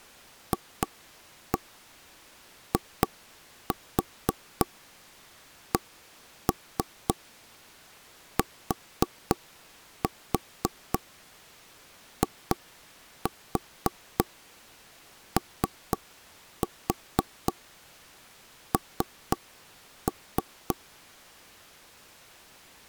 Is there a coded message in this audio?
Yes: tap code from 0.5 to 20.8 s, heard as knocks on wood, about 3 knocks a second. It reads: FICTION